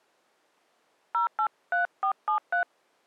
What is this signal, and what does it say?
DTMF, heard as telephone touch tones, dialled by hand, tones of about 110 ms. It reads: 083473